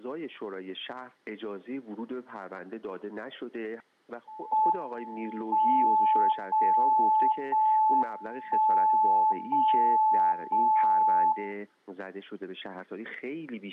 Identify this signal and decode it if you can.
Radio time signal (JJY), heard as a tone whose level steps once a second, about 870 Hz, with room echo. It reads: M 0 0 1 0 0 0